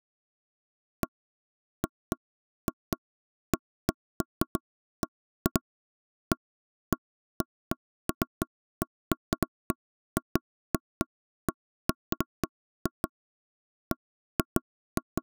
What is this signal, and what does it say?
Irregular knocks on wood. There is no code.